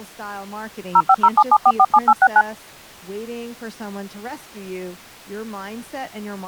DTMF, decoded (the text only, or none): 05077447869